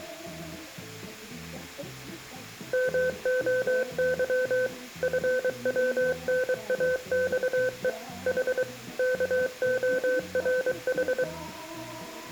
Morse code (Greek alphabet), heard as a keyed tone, machine-sent, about 23 wpm, 510 Hz, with room echo. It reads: ΜΟΥ ΦΩΝΑΞΕ Η ΚΟΡΗ